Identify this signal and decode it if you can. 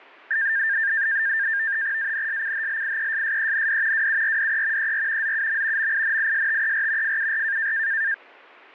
NAVTEX (SITOR-B), 100 baud, 170 Hz shift, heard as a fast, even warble, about 1700 Hz centre. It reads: ANSCHLIESSEND WURDE ER ZUM MINISTER FUR